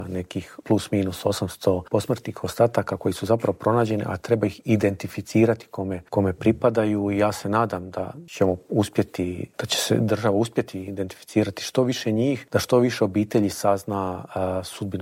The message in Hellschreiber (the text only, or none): none